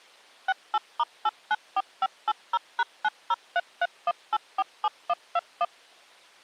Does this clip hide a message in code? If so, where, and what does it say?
Yes: DTMF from 0.5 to 5.6 s, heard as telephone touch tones, dialled by machine, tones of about 40 ms. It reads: 68*894580#90331847121